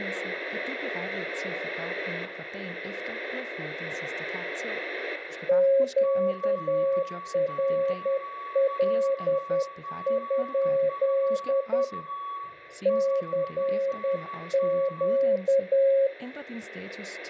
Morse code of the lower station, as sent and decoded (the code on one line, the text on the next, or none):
--.- .-. .-.. ..--.. / -.-. --.-
QRL? CQ